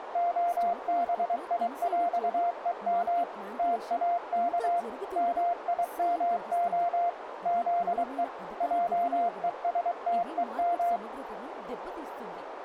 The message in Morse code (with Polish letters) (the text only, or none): … TAK MIMO ZE JESTEM